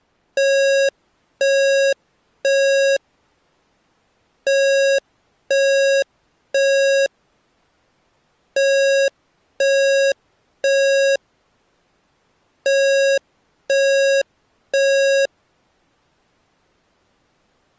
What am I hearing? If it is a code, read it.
Alarm pattern, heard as an alarm's beeps, played four times, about 550 Hz. Temporal three. Smoke or fire, evacuate.